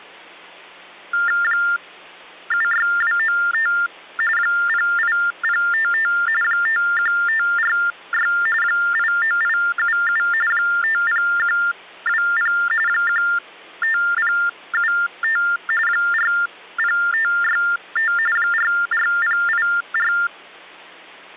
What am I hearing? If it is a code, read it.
TTY/TDD text telephone tones (45.45 baud Baudot), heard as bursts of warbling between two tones, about 400 Hz shift, 1600 Hz centre, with hum. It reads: 76295 08055 51546 89877 50120 15075 40565 44084